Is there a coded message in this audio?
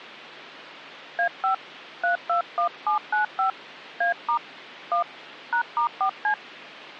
Yes: DTMF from 1.2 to 6.3 s, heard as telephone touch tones, dialled by hand, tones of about 110 ms. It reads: A5 321795 A* 1 #*4C